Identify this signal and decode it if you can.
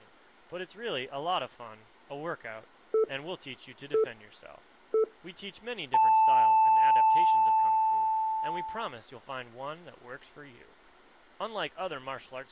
Radio time signal (three low pips and a long one an octave up, as on NHK), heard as pips.